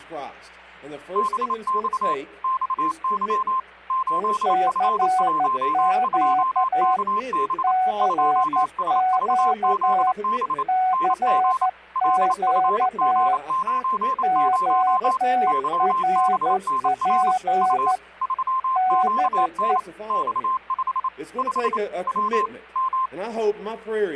Morse code, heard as two keyed tones. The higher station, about 28 wpm, 1050 Hz: BX XY 8F12KB 2SVZB NG LFG90 YBNR U 3QN X5 5 W M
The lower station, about 13 wpm, 740 Hz: CQ CQ CQ QRP DE